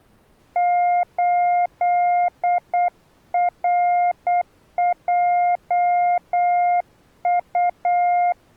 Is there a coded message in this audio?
Yes: Morse code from 0.5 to 8.4 s, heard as a keyed tone, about 8 wpm, 710 Hz. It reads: 8RJU